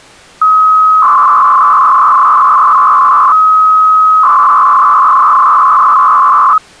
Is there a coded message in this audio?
Yes: 300-baud modem data (Bell 103 tones) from 0.4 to 6.6 s, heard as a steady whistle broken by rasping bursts, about 300 baud, 200 Hz shift.